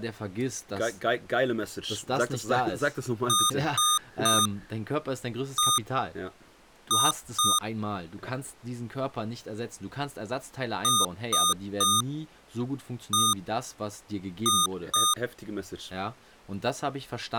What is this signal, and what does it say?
Beep code, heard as beeps from a small speaker, played twice, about 1220 Hz, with speech in German. 3-1-2. In Phoenix BIOS tables: DMA register failure.